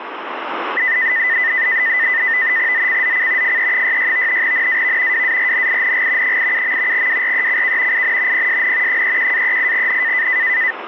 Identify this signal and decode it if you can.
NAVTEX (SITOR-B), 100 baud, 170 Hz shift, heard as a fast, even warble, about 1900 Hz centre. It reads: ZCZC FE66 NAV WARNING 87. WRECK IN PSN 31-38N